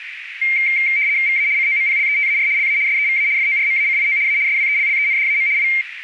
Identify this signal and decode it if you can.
RTTY (75 baud, 170 Hz shift), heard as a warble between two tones, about 2200 Hz centre, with radio static and a narrow filter. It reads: VA COMPLETAR LA SEVA FORMACIO A SWELLENDAM I